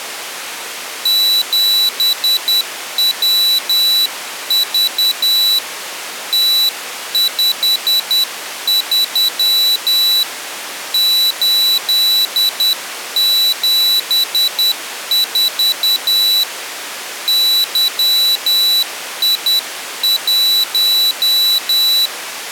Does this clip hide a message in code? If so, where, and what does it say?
Yes: Morse code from 1.0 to 22.1 s, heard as a high beeper, hand-sent with a paddle, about 10 wpm, 3950 Hz. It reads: 7WV T53 874 YI1